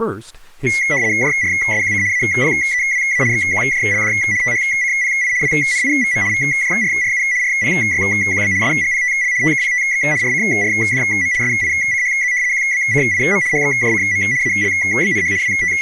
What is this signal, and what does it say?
RTTY (75 baud, 170 Hz shift), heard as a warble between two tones, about 2050 Hz centre, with speech in English. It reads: JRSQC APEWA XQJLD THCPI WNIVM VJRRU RPYQB SGPTL TKPTX RCRDM SICHZ QBCIM HXJCM ALBNH …